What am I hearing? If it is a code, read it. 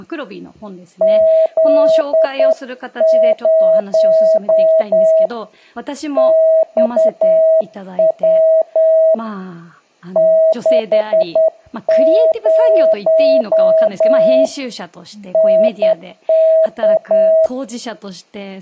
Morse code, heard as a keyed tone, hand-sent with a straight key, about 10 wpm, 640 Hz, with speech in Japanese. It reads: Z0 XW 60 NK